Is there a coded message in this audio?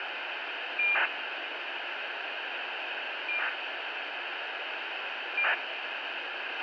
Yes: ACARS aircraft data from 0.8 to 5.5 s, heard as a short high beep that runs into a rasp, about 2400 baud, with radio hiss and a squelch burst at the end.